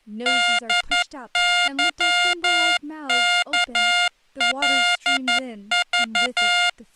Morse code, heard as electronic beeps, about 11 wpm, 710 Hz, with speech in English. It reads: DYKLV